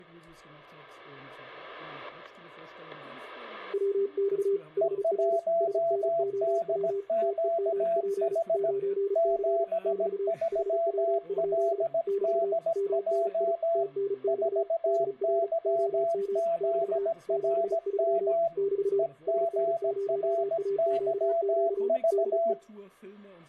Morse code, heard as two keyed tones, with static crashes. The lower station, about 35 wpm, 400 Hz: WX HR SNOW TEMP 9C <BT> HW? <BT> MNI TNX DR OM <BT> 73 <BT> SN0AQQ DE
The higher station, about 17 wpm, 670 Hz: E1DQH 73LDJ 4YZRM EGRYV